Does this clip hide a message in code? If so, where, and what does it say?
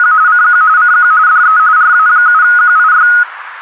Yes: RTTY (45.45 baud, 170 Hz shift) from 0.0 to 3.2 s, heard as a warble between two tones, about 1360 Hz centre, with radio static. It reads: … CQ CQ DE RA7QIY